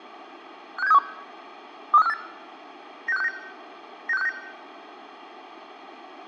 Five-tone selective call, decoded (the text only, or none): 56731 23548 96569 96569